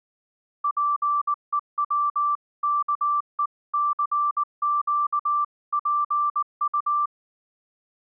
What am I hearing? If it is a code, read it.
Morse code (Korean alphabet), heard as a keyed tone, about 19 wpm, 1170 Hz. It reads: 잡아채지